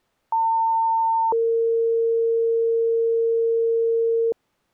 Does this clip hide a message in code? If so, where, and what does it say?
Yes: two-tone page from 0.3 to 4.3 s, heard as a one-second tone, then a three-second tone, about 900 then 460 Hz.